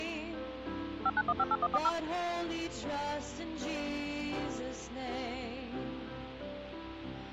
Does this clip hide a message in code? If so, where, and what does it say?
Yes: DTMF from 1.1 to 1.9 s, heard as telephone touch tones, dialled by machine, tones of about 50 ms. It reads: 59158140